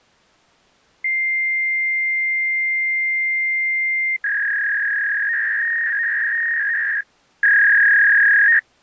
Fax machine handshake, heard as a long tone and a warble.